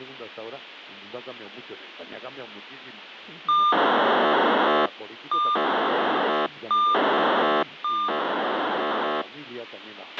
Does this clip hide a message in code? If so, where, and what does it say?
Yes: POCSAG pager data (2400 baud) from 3.5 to 9.2 s, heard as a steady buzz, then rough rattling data, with radio hiss and a squelch burst at the end.